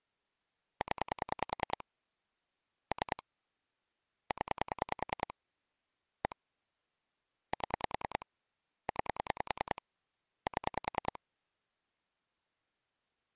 Pulse dialling, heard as clicks on a phone line, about 10 pulses a second. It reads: 0 3 0 1 7 9 7